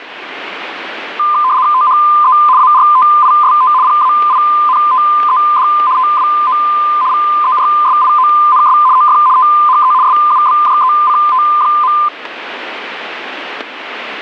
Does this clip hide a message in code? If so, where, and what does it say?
Yes: RTTY (75 baud, 170 Hz shift) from 1.2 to 12.1 s, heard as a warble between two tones, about 1110 Hz centre, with radio static and static crashes. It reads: THE ARTIST PAINTED TWO VERSIONS OF THE SUBJECT.